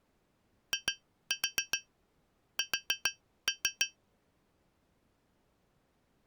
Tap code, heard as taps on glass, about 7 knocks a second. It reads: IS